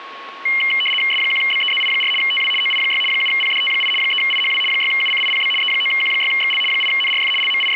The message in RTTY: S1BEZI4 TW OI6 7PDT8 3IHW 6UCIPB E9Q6XL 8NRF …

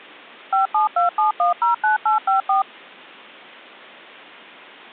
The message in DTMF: 5727109854

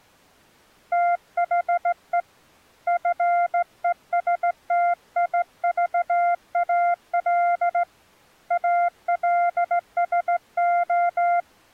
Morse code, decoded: THE FESTIVAL ALSO

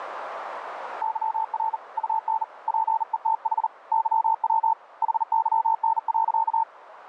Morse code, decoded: YR UN PETH YW HYN.

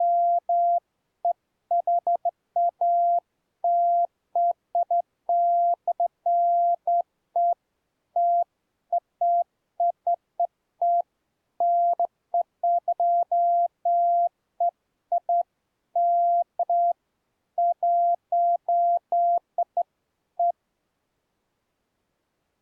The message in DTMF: none

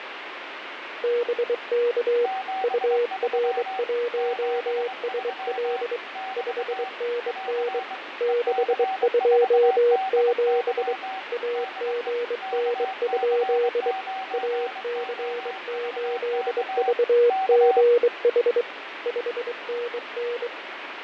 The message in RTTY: none

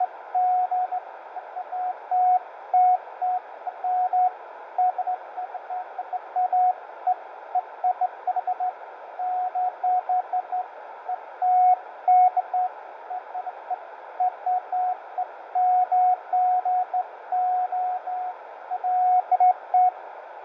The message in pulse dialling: none

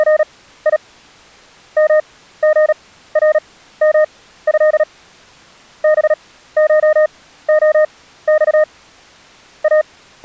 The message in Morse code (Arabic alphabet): … مغرمه بشخص …

